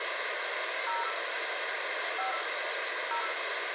DTMF, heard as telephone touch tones, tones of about 130 ms, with radio hiss, a squelch burst at the end and room echo. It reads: 0 5 0